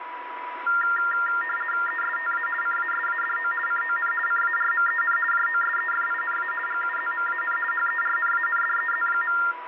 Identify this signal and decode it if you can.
RTTY (50 baud, 450 Hz shift), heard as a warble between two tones, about 1600 Hz centre, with radio static and a steady whistle near 980 Hz. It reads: ESTA CASADO CON CARMEN JOSEFINA GUZMAN HERNANDEZ.